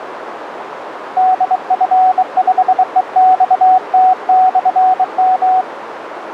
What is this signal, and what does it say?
Morse code, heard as a keyed tone, hand-sent with a bug key, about 23 wpm, 750 Hz, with radio static and a narrow filter. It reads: DF5EXT/M